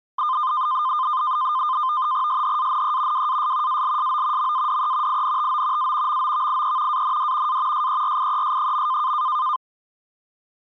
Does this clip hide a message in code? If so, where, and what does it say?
Yes: NAVTEX (SITOR-B), 100 baud, 170 Hz shift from 0.2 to 9.6 s, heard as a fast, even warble, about 1120 Hz centre. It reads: SHANE WAS ALSO MADE INTO A MOVIE AND A SERIES.